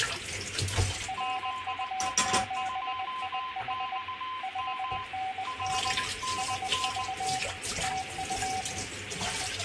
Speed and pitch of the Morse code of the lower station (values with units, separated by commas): 20 wpm, 760 Hz